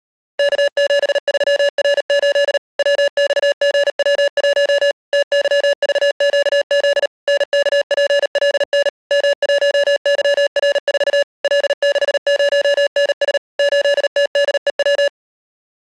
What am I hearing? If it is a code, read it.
Morse code, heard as electronic beeps, machine-sent, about 38 wpm, 570 Hz. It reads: K73R8 WXGW1 TYVQZ NKPLN M1YR4 L60NS 8TDEW